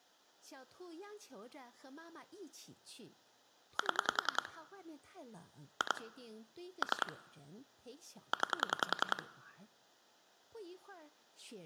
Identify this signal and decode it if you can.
Pulse dialling, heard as clicks on a phone line, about 10 pulses a second, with speech in Chinese. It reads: 7 2 3 9